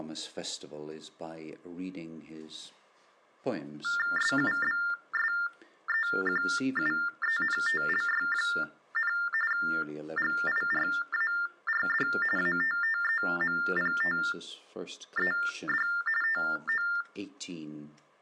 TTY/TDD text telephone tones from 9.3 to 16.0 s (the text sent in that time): GIRARD ATTEMPTED